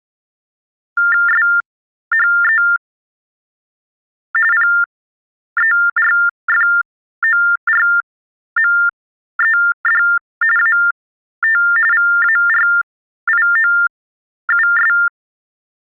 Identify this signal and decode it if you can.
TTY/TDD text telephone tones (45.45 baud Baudot), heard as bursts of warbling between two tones, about 400 Hz shift, 1600 Hz centre. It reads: SHE PERFORMED AT VARIOUS